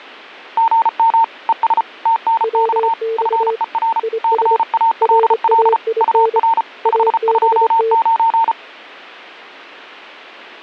Morse code, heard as two keyed tones. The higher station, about 34 wpm, 910 Hz: GM ES TNX FER CALL UR 529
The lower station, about 25 wpm, 450 Hz: WX IS RAIN ABT